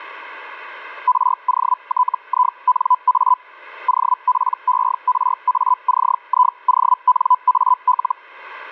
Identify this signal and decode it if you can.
Hellschreiber (Feld-Hell, 122.5 baud), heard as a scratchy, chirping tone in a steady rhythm, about 1000 Hz. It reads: ROTINA OPERACIONAL